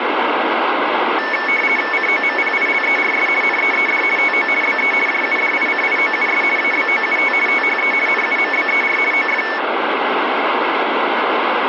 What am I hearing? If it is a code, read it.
RTTY (50 baud, 450 Hz shift), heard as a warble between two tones, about 2000 Hz centre, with radio static. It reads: COMPILERS NEED TO BE JUDICIOUS ABOUT THE NUMBER OF